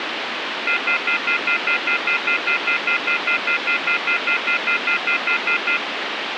Telephone call progress tone (North American plan), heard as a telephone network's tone, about 1400, 2050, 2450, 2600 Hz, 0.1 s on and 0.1 s off, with phone line noise. Off-hook warning tone.